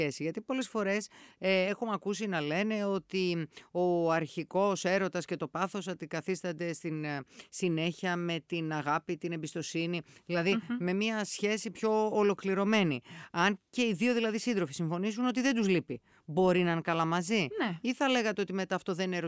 Speech in Greek. There is no code.